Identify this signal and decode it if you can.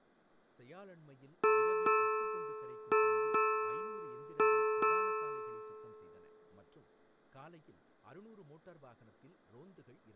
Ship's bell, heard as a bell, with room echo and speech in Tamil. 6. Six half-hours of the watch have passed.